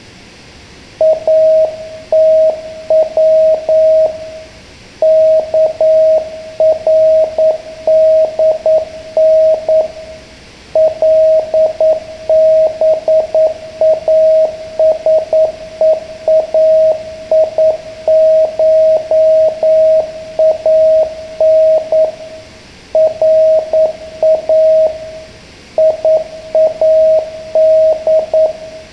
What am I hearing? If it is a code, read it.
Morse code (Persian alphabet), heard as a keyed tone, hand-sent with a paddle, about 9 wpm, 630 Hz, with room echo. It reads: اتو کردن لباسهایشان را یاد